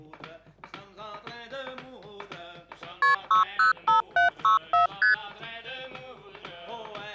Multi-frequency trunk signalling (R1, as on North American trunks), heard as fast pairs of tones, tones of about 130 ms. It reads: KP 605764 ST